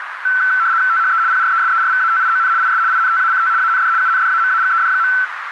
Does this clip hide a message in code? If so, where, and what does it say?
Yes: RTTY (75 baud, 170 Hz shift) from 0.2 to 5.2 s, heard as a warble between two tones, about 1430 Hz centre, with radio static and a narrow filter. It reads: THE PRESERVATION IS INTACT AND UNDAMAGED.